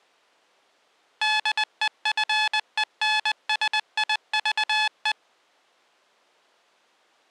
Morse code, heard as electronic beeps, machine-sent, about 20 wpm, 860 Hz. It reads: DEFENSIVE